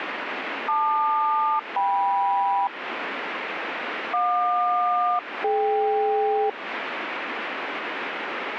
Aircraft SELCAL, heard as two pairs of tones, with radio static. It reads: LQ-KM JQ-DK